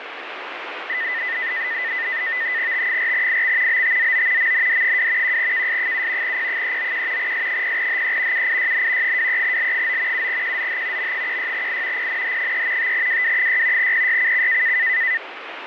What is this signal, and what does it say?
NAVTEX (SITOR-B), 100 baud, 170 Hz shift, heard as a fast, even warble, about 1900 Hz centre, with radio static. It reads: T4IX BTZO MND2 1KS7 P391 S0HE UIYN 23L9 7QZH M16I PNH3 5WW6 PYCC